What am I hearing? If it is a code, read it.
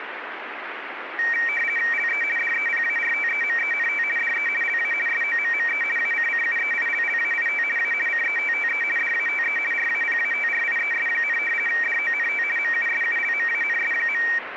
RTTY (50 baud, 450 Hz shift), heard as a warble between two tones, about 2100 Hz centre, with radio static. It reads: LE DEPARTEMENT DE LA SOMME ACCUEILLAIT A CETTE DATE RAPATRIES, DONT MUSULMANS.